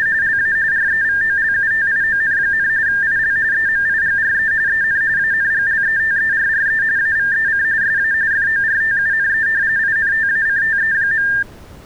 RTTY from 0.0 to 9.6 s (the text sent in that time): … LA REVOLUTION, IL EMIGRE EN ANGLETERRE AVEC SA FORTUNE